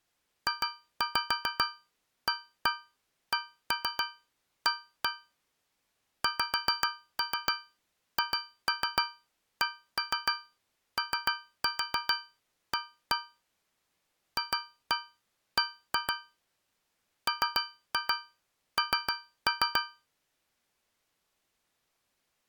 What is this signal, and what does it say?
Tap code, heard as taps on a metal pipe, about 7 knocks a second. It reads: JACA XHCOA FB MN